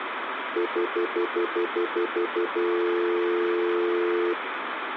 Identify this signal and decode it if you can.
Telephone call progress tone (North American plan), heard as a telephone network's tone, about 350, 440 Hz, 0.1 s on and 0.1 s off, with phone line noise. Stutter dial tone.